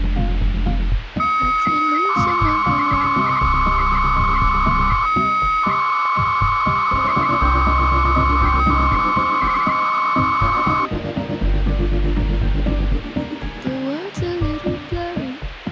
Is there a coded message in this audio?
Yes: 300-baud modem data (Bell 103 tones) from 1.2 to 10.9 s, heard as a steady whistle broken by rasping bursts, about 300 baud, 200 Hz shift, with phone line noise.